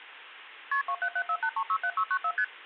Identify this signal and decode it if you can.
Multi-frequency trunk signalling (R1, as on North American trunks), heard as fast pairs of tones, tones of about 70 ms. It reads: KP 27748367694 ST